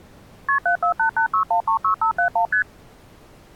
Multi-frequency trunk signalling (R1, as on North American trunks), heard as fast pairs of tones, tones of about 100 ms. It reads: KP 74886136571 ST